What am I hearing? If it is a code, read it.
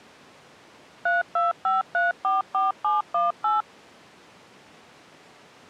DTMF, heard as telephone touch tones, dialled by machine, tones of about 160 ms. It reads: 325344718